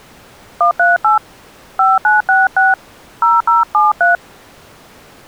DTMF, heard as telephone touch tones, dialled by hand, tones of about 140 ms. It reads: 138 5966 0073